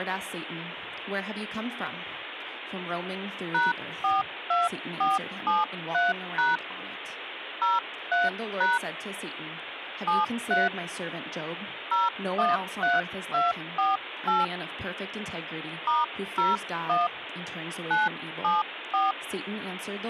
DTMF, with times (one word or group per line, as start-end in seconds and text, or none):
3.5-6.6 #42473#
7.6-8.8 03#
10.1-10.7 73
11.9-14.4 013248
15.9-17.1 *01
17.9-19.1 974